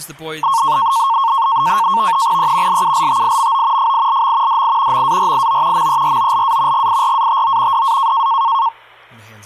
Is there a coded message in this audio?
Yes: NAVTEX (SITOR-B), 100 baud, 170 Hz shift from 0.4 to 8.7 s, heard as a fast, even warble, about 1000 Hz centre, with speech in English. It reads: E LULTIMO FILM DI MARIO MEROLA GIRATO DA